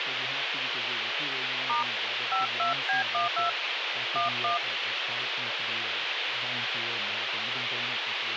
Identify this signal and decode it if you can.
DTMF, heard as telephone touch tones, dialled by hand, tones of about 140 ms, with radio hiss and speech in English. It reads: * 52B12 11